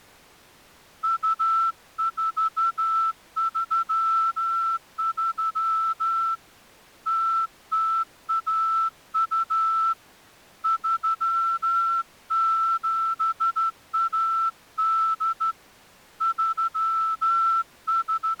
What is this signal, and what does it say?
Morse code (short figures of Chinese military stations), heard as a whistle, hand-sent with a straight key, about 13 wpm. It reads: 2433 0012 3718 …